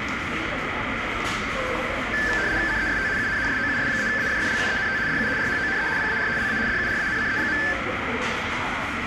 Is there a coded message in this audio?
Yes: RTTY (75 baud, 170 Hz shift) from 2.1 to 7.7 s, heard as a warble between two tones, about 1650 Hz centre, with radio static, a narrow filter, room echo and the noise of a crowd indoors. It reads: CEST UN SOUS-AFFLUENT DU RHONE PAR LA DURANCE.